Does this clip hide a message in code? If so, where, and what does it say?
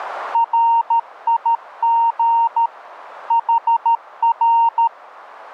Yes: Morse code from 0.3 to 4.9 s, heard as a keyed tone, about 13 wpm, 920 Hz. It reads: RIG HR